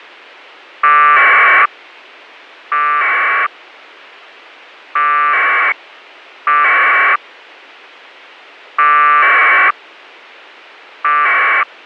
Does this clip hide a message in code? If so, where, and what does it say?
Yes: packet radio (AX.25, as in APRS), 1200 baud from 0.8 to 11.6 s, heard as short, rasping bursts.